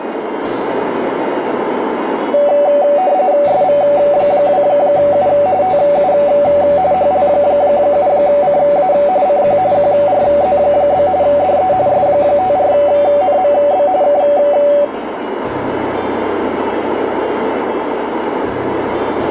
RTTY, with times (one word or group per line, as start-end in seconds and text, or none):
3.5-5.3 SV2U
5.6-6.1 TU
6.9-8.9 HL7CA
9.3-9.6 CQ
9.7-11.1 QRZ?
11.2-11.7 DE
11.9-13.9 S54NMB
14.0-14.2 K